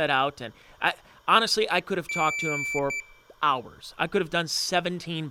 Beep code, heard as a piezo beeper, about 2350 Hz, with room echo and speech in English. 1 long, 1 short. In IBM BIOS tables: system board problem.